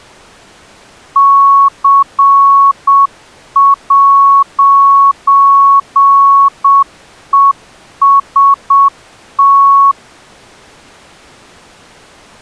Morse code, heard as a keyed tone, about 7 wpm, 1110 Hz. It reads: C'EST